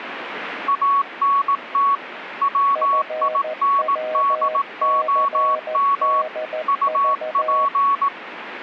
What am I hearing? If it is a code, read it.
Morse code, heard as two keyed tones, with radio static. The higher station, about 18 wpm, 1120 Hz: ANT WINDOM UP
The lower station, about 14 wpm, 620 Hz: FWCDV